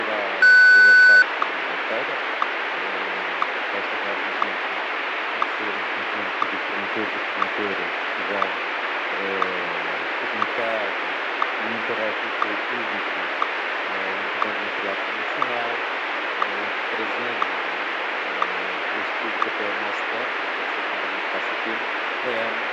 Radio time signal (WWVH, Hawaii), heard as ticks, one a second, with radio static.